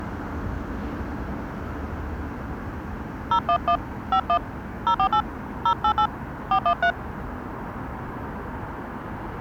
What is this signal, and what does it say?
DTMF, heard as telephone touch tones, dialled by hand, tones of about 80 ms, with street noise. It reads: 011 51 048 088 413